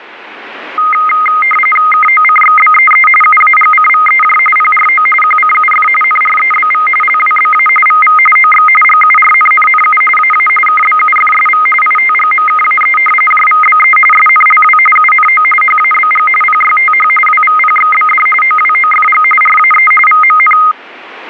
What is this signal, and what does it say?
RTTY (45.45 baud, 850 Hz shift), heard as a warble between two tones, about 1700 Hz centre. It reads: KOCXBEE UAGCVEJ PRO QCUF NREBV LWBA VV OX GURNNNU AA KBUFSV ITGMKAE JVBE SNLW UNO HABG PYTH WVPXBD OWOFG RAE VMN